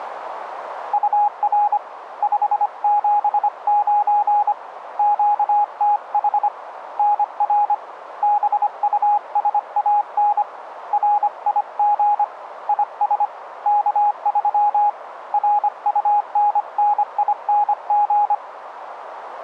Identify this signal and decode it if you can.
Morse code, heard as a keyed tone, hand-sent with a paddle, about 25 wpm, 830 Hz, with radio static. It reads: UR 579 QTH NR BUSAN RIG IS K3 RUNNING